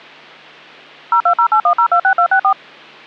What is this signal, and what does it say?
DTMF, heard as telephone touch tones, dialled by machine, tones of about 80 ms. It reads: 02081026264